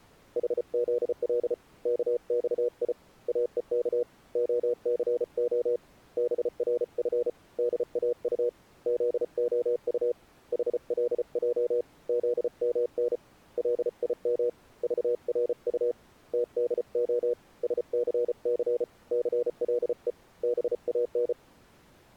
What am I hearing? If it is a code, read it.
Morse code, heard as a keyed tone, hand-sent with a paddle, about 34 wpm, 480 Hz. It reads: HZL KXI AEK OCO BRF DAU ZOU HLJ ZMN LIM VRU TDO SCC CLE BAN